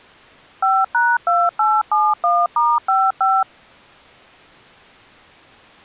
DTMF, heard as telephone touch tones, dialled by machine, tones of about 220 ms. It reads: 5#2871*55